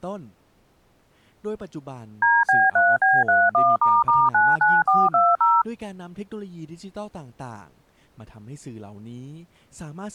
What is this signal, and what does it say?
DTMF, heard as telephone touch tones, dialled by machine, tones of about 210 ms, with speech in Thai. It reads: DB3B31**99420